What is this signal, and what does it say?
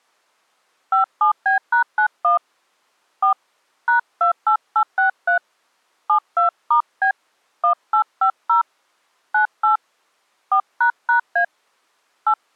DTMF, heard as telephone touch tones, dialled by hand, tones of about 100 ms. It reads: 57B#91 4 #28863 72*B 1850 98 4##A 8